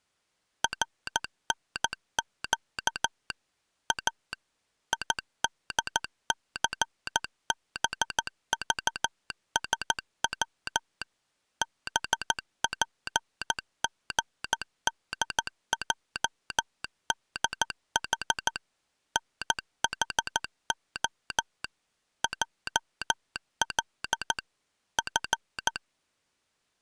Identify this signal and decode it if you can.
Morse code, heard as a telegraph sounder, machine-sent, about 14 wpm. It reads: RNQ A IDCBVSW BPGDJDH NHO JL F